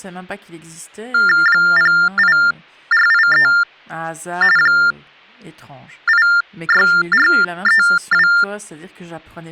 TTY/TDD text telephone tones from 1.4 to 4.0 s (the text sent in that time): 08483